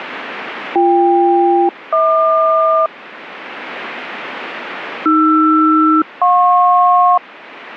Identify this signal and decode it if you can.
Aircraft SELCAL, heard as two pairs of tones. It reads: BK-HQ AR-JP